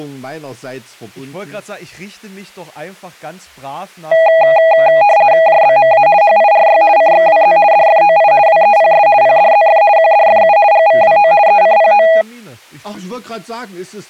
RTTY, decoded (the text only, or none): JBMA HIRY CXWZ DFOI WEPS PDZF QDFU GVWO ECPO